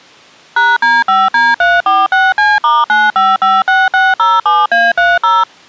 DTMF, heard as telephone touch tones, dialled by machine, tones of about 200 ms. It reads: #D5D346C*9556607A30